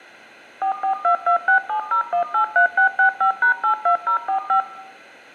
DTMF, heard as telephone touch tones, dialled by machine, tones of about 100 ms, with room echo. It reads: 4422670183665#82045